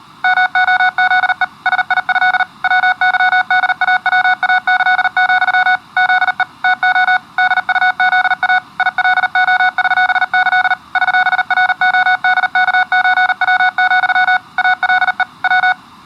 Morse code (with Polish letters), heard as electronic beeps, machine-sent, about 39 wpm, 740 Hz. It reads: MOZE SIĘ WYDAWAĆ, ZE TO DUZA ILOŚĆ ŚRODKÓW, ALE W